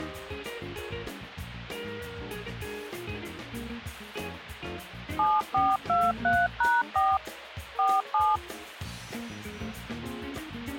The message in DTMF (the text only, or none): 7423#4 47